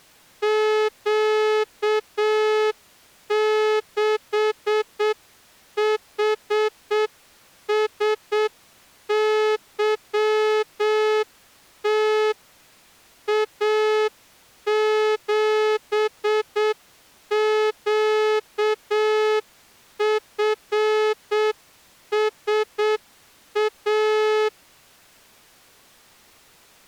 Morse code, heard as a horn, hand-sent with a straight key, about 7 wpm. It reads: Q6HSYT A7QFSA